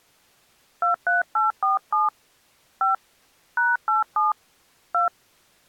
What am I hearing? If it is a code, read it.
DTMF, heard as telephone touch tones, dialled by hand, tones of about 150 ms. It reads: 23847 5 #87 2